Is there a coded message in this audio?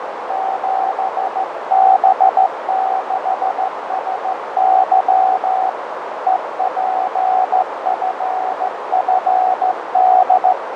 Yes: Morse code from 0.2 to 10.6 s, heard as a keyed tone, hand-sent with a straight key, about 14 wpm, 760 Hz, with heavy radio static, fading and a narrow filter. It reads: 7B6SY EPFFD